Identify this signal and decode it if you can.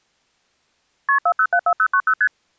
Multi-frequency trunk signalling (R1, as on North American trunks), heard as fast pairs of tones, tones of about 70 ms. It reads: KP 4074090 ST